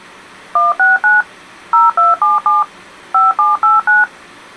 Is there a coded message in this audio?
Yes: DTMF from 0.6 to 4.0 s, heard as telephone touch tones, dialled by machine, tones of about 170 ms. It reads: 169 0277 5789